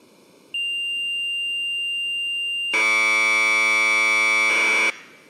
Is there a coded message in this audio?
Yes: Commodore tape loading (standard loader) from 0.5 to 4.9 s, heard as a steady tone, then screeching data.